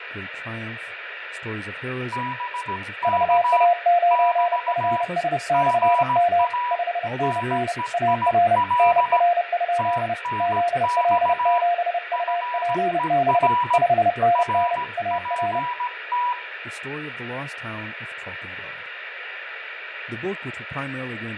Morse code, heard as two keyed tones, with radio static, fading, room echo and speech in English. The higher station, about 17 wpm, 980 Hz: BK <BT> GA NEIL TNX FER RPT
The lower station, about 30 wpm, 700 Hz: VA9FS/M 5NN AR NR? ZL7UPB 5NN AR